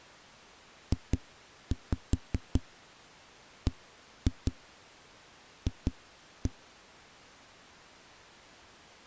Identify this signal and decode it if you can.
Tap code, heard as knocks on a wall, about 5 knocks a second. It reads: JBF